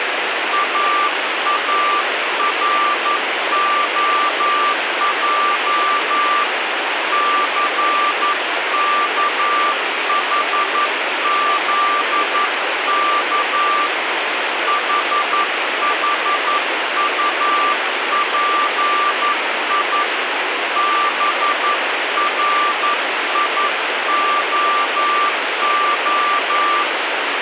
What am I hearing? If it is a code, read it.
Morse code, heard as a keyed tone, hand-sent with a paddle, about 11 wpm, 1180 Hz, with radio static. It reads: AAROJ CKHZK HHUPI BRIOO